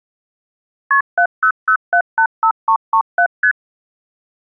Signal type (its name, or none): multi-frequency trunk signalling